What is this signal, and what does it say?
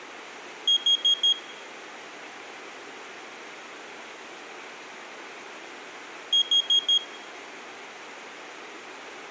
Alarm pattern, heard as an alarm's beeps, played twice, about 3250 Hz. Temporal four. Carbon monoxide.